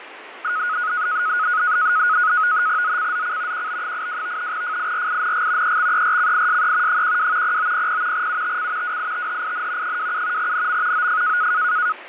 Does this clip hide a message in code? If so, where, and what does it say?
Yes: NAVTEX (SITOR-B), 100 baud, 170 Hz shift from 0.4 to 11.9 s, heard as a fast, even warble, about 1360 Hz centre, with radio static and fading. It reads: ZCZC QB82 FIRING EXERCISE 12 0900 UTC WITHIN 27 NM OF